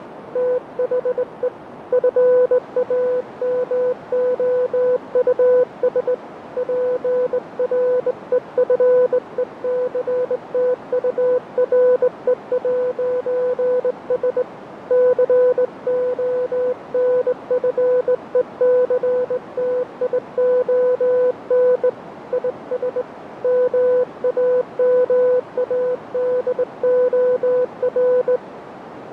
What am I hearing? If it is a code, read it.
Morse code, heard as a keyed tone, hand-sent with a straight key, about 20 wpm, 500 Hz, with radio static and a narrow filter. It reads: THE FAMOUS PREFECTURE'S CONFECTION IS MAMADOR